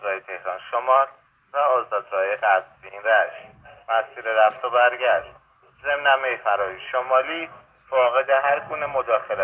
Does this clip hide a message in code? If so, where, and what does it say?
No.